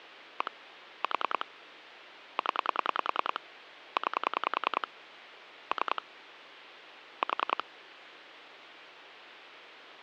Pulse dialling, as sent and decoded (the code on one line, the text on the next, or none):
1 / 4 / 10 / 9 / 3 / 4
1 4 0 9 3 4